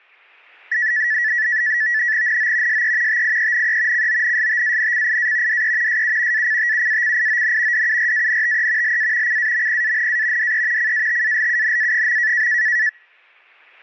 NAVTEX (SITOR-B), 100 baud, 170 Hz shift, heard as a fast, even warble, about 1850 Hz centre. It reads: NO SE TIENE CONSTANCIA DE SU ACTUACION DURANTE LA CAMPANA DE CATALUNA.